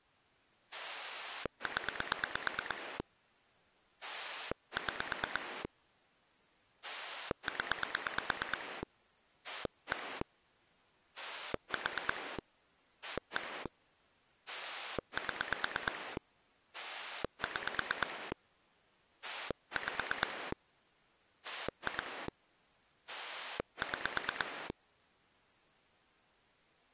Pulse dialling, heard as a rotary dial, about 8 pulses a second. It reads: 0 6 0 1 4 1 7 6 5 2 6